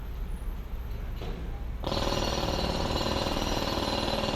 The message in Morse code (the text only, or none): none